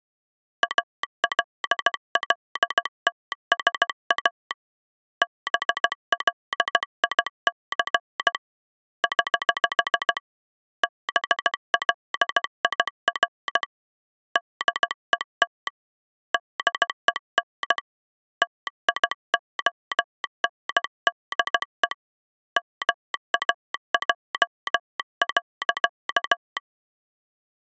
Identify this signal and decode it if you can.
Morse code, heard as a telegraph sounder, hand-sent with a paddle, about 16 wpm. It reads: ALLTSA BLIC <HH> BLIR DET DEN TIONDE MAJ.